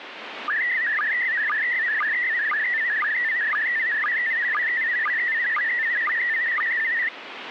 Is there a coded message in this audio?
Yes: SSTV (slow-scan television), PD 120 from 0.5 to 7.1 s, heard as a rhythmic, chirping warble, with radio static.